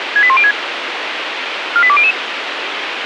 Five-tone selective call (ZVEI), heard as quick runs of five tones, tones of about 70 ms, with radio hiss. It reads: 68106 48200